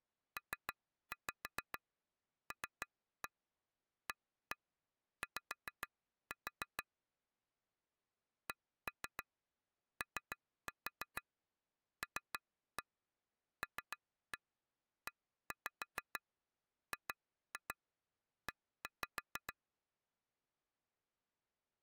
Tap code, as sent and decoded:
3-5 3-1 1-1 5-4 / 1-3 3-4 3-1 3-1 1-5 2-2 1-5
PLAY COLLEGE

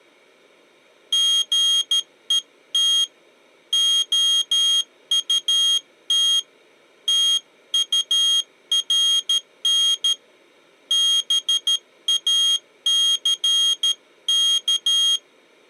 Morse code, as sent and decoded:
--. . - / --- ..- - / - ..- .-. -. / -... .- -.-. -.-
GET OUT TURN BACK

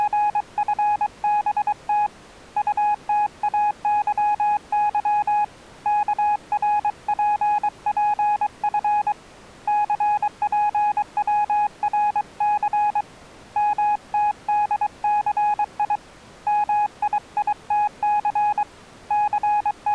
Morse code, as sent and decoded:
… / ..- - .- -.-- -.-- / -.- .-. .--. .--. ..-. / -.-. .--. .-- .-. -.-. / -- - -.. -.-. .. / -- .. .. - -.-. / …
… UTAYY KRPPF CPWRC MTDCI MIITC …

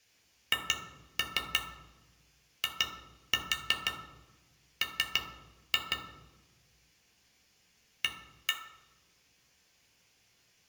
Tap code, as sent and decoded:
2-3 2-4 3-2 / 1-1
HIM A

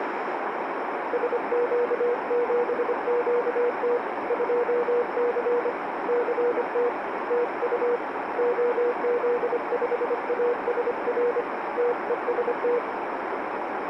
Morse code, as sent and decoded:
... --.- --... --.- - / ..--- -.-. / -.-. - / - ..- / --- --.. ..... .- ... .-. / - . ... -
SQ7QT 2C CT TU OZ5ASR TEST

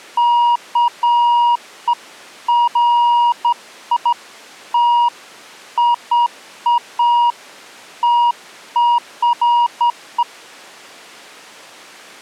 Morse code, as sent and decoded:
none

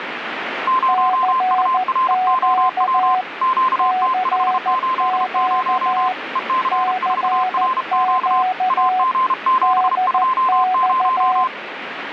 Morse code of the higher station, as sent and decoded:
----- ..- .-. --- .-- / --.- - ..... ---.. ----- / . -.-. ....- .-. --.- / .- --. --... ..--- -----
0UROW QT580 EC4RQ AG720

